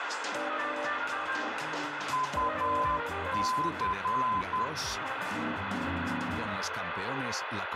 Morse code, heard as a keyed tone, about 10 wpm, 1020 Hz, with radio static and room echo. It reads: UC